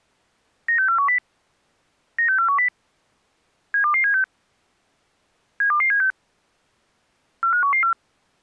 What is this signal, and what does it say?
Five-tone selective call (CCIR), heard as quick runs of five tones, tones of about 100 ms. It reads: 96410 96410 72276 72276 45114